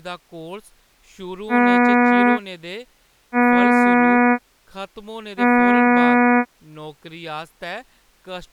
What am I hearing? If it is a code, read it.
Ship horn signal, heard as a ship's horn, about 240 Hz, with speech in Dogri. 3 short. At sea: I am operating astern propulsion.